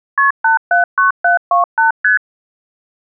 Multi-frequency trunk signalling (R1, as on North American trunks), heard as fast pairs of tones, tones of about 130 ms. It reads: KP 879728 ST